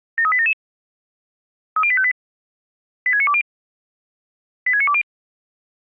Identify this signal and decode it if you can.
Five-tone selective call (ZVEI), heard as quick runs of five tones, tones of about 70 ms. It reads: 73877 30858 86920 86920